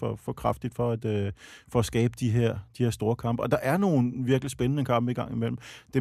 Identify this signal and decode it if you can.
Speech in Danish. There is no code.